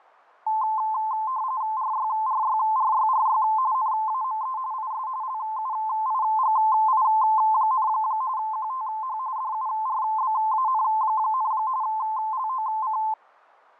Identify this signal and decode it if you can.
RTTY (45.45 baud, 170 Hz shift), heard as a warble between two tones, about 960 Hz centre, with fading. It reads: RYRYRYRY NAME IS LUIGI, QTH DURBAN, LOC